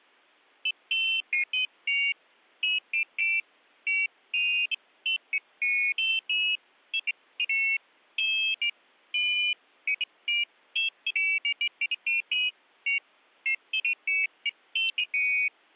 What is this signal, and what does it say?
Pairs of high tones at irregular times. There is no code.